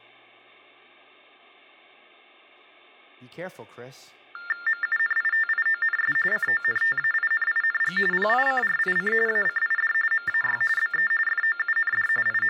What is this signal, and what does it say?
TTY/TDD text telephone tones (45.45 baud Baudot), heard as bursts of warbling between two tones, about 400 Hz shift, 1600 Hz centre, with speech in English. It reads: MUNITIONS CONTAINING PICRIC ACID MAY BE FOUND …